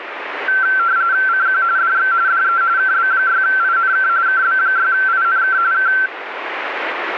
RTTY (45.45 baud, 170 Hz shift), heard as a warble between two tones, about 1450 Hz centre, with radio static. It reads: CQ DX DE KB6INK KB6INK K